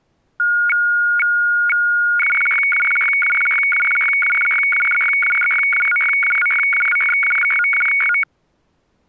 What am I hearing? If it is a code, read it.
Weather fax (radiofax), 120 lines a minute, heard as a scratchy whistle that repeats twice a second.